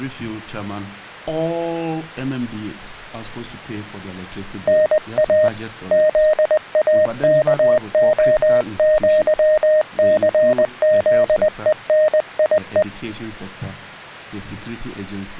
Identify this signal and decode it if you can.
Morse code (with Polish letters), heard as a keyed tone, hand-sent with a paddle, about 20 wpm, 620 Hz. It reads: NA ZAKOŃCZENIE